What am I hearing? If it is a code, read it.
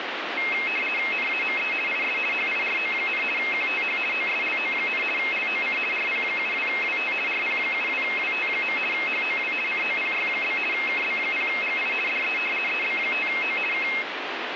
RTTY (50 baud, 450 Hz shift), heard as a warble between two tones, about 2350 Hz centre, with radio static. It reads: NAME IS HIRO, QTH OSLO, LOC RP72WT RP72WT. HOW COPY? KB0GI DE EB5O K